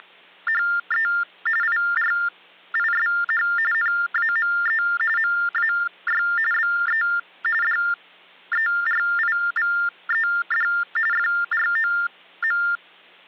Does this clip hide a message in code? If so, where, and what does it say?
Yes: TTY/TDD text telephone tones (45.45 baud Baudot) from 0.0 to 12.8 s, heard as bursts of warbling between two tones, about 400 Hz shift, 1600 Hz centre, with hum. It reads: … IRISH NAME MAY BE DERIVED FROM